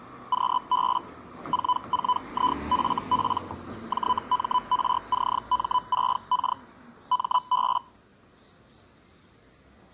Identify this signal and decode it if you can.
Hellschreiber (Feld-Hell, 122.5 baud), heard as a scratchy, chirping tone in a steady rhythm, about 1000 Hz, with the noise of a residential street. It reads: QB 44IFP JMRCM6K MB